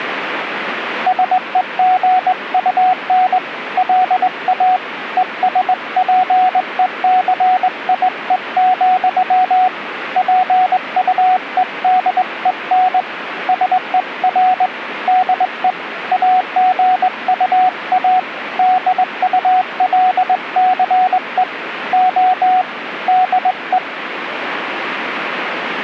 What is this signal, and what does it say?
Morse code, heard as a keyed tone, hand-sent with a straight key, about 20 wpm, 740 Hz, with radio static. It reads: SEGUN LA ESPECIE, PUEDEN SER DE AGUA DULCE O DE